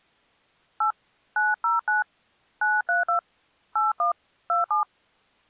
DTMF, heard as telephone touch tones, dialled by hand, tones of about 140 ms. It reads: 8 909 932 81 27